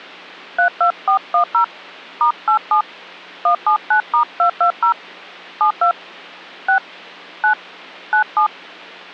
DTMF, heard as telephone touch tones, dialled by hand, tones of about 100 ms. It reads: 32410 *87 179*220 72 6 9 97